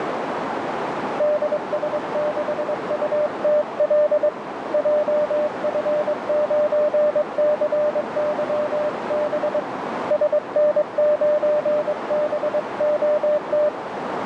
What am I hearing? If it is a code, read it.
Morse code, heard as a keyed tone, hand-sent with a straight key, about 22 wpm, 600 Hz, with radio static and a narrow filter. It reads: DS6UTL JF9CYB SN9BOT